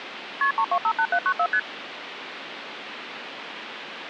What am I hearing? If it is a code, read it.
Multi-frequency trunk signalling (R1, as on North American trunks), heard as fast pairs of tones, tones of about 70 ms, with phone line noise. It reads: KP 3258794 ST